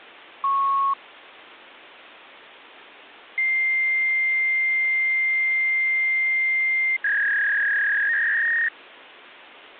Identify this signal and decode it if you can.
Fax machine handshake, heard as a beep, a long tone and a warble.